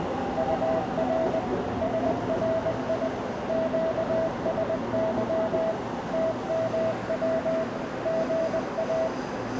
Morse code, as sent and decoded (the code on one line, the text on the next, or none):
..- .-. / ... .-. .. / --.- ... -.-- / - -- .-- / --. .-
UR SRI QSY TMW GA